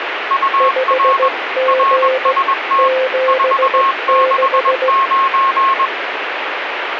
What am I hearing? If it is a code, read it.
Morse code, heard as two keyed tones, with radio static. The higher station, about 21 wpm, 1090 Hz: UR RST 469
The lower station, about 16 wpm, 520 Hz: 5G 76